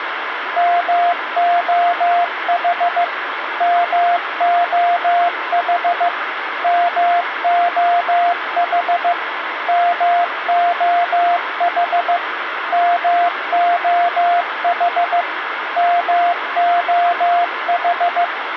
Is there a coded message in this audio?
Yes: Morse code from 0.5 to 18.3 s, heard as a keyed tone, machine-sent, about 15 wpm, 700 Hz, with radio hiss. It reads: MOH MOH MOH MOH MOH MOH